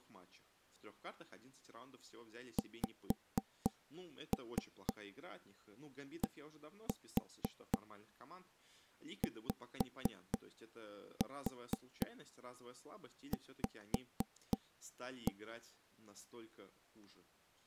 Tap code, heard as knocks on wood, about 4 knocks a second, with speech in Russian. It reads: XDYV